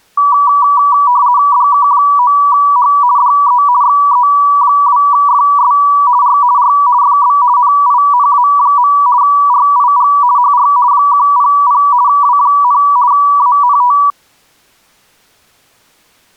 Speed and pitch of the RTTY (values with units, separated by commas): 50 baud, 170 Hz shift, 1060 Hz centre